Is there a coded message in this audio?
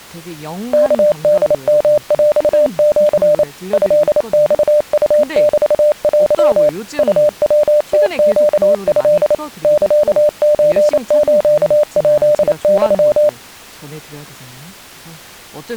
Yes: Morse code (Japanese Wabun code) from 0.7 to 13.4 s, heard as a keyed tone, machine-sent, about 28 wpm, 600 Hz, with speech in Korean. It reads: ワホヨヰシ トマウメテ ウヤムネト サソスヱユ